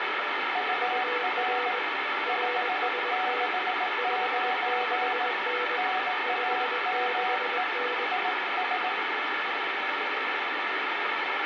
Morse code, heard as two keyed tones, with heavy radio static. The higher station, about 18 wpm, 740 Hz: UR 569 NAME IS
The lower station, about 21 wpm, 490 Hz: UR RST 56N 56N